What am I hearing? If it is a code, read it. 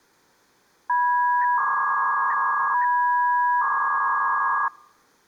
300-baud modem data (V.21 tones), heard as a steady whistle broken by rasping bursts, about 300 baud, 200 Hz shift.